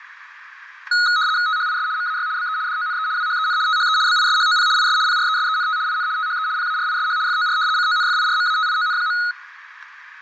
RTTY (75 baud, 170 Hz shift), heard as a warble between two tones, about 1360 Hz centre, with fading. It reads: THIS MAY BE DONE WHEN THE BISHOP IS PRESENT IN THE PARISH FOR CONFIRMATION.